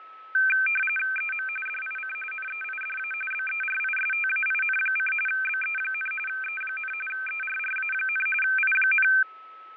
RTTY (45.45 baud, 850 Hz shift), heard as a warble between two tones, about 1950 Hz centre, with fading and a steady whistle near 1300 Hz. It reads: EM DIC NEIDA BERISTAIN: BE, E, ERRA, I,